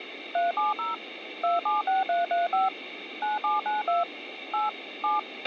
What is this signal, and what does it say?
DTMF, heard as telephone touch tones, dialled by machine, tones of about 160 ms, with radio hiss and a squelch burst at the end. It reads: 370 276335 9792 8 7